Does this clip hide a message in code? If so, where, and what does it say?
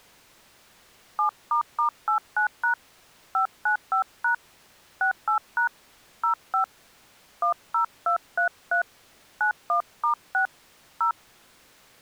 Yes: DTMF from 1.2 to 11.1 s, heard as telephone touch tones, dialled by hand, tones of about 100 ms. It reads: 7**89# 595# 68# 05 10233 91*6 0